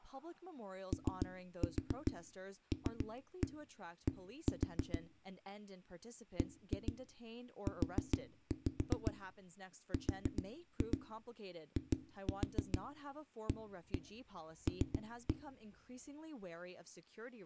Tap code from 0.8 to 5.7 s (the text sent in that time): OLD